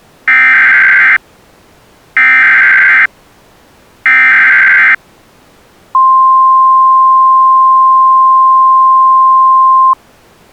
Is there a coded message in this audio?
Yes: Emergency Alert System (SAME) tones (header bursts, then the 1050 Hz attention tone) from 0.3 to 9.9 s, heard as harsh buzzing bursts, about 520.83 baud.